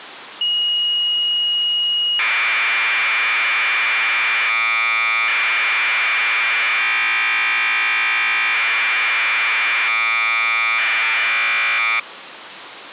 Commodore tape loading (standard loader), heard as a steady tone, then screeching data.